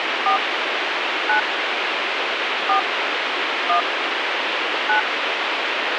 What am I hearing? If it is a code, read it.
DTMF, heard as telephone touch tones, dialled by hand, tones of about 110 ms, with radio hiss. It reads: 4 9 4 1 9